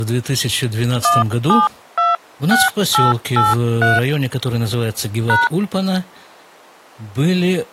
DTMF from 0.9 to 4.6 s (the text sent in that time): 1726883